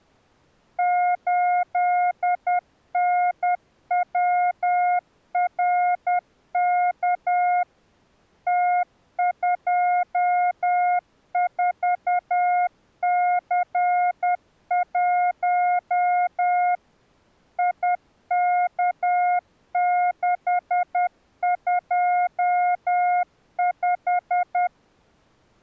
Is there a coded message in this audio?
Yes: Morse code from 0.7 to 24.7 s, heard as a keyed tone, machine-sent, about 10 wpm, 720 Hz. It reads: 8NWRK T24C1 IK625